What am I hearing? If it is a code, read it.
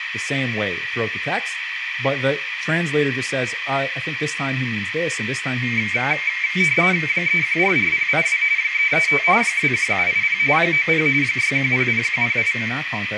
RTTY (45.45 baud, 170 Hz shift), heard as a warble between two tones, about 2200 Hz centre, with radio static, a narrow filter and speech in English. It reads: 3144082 335 21780 90 6100108